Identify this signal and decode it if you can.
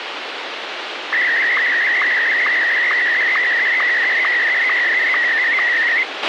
SSTV (slow-scan television), Martin M1, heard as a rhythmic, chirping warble, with radio hiss and a squelch burst at the end.